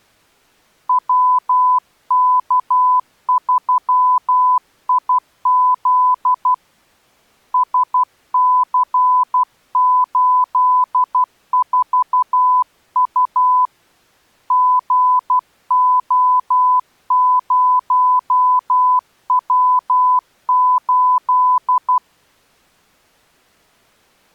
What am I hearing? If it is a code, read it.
Morse code, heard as a keyed tone, hand-sent with a paddle, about 12 wpm, 1000 Hz. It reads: WK3IZ SC84U GO0W8